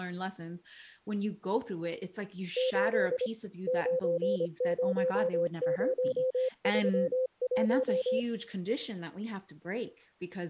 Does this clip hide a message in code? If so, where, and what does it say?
Yes: Morse code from 2.5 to 8.3 s, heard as a keyed tone, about 25 wpm, 520 Hz, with speech in English. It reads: 8 90031